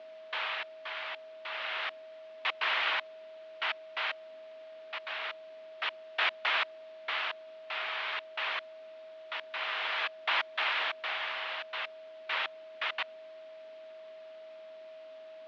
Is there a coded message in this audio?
No, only bursts of noise, with radio static, fading and a steady whistle near 640 Hz.